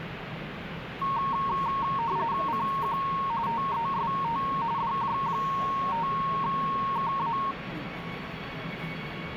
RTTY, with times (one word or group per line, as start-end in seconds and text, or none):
2.5-3.0 CQ
3.5-4.4 TEST
4.8-7.4 DJ5KA